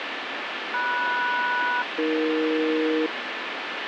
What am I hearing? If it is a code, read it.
Aircraft SELCAL, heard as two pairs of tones, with heavy radio static. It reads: MS-AE